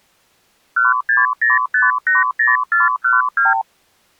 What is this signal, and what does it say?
Multi-frequency trunk signalling (R2, with the far end's replies), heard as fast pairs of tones, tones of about 160 ms. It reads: 160580412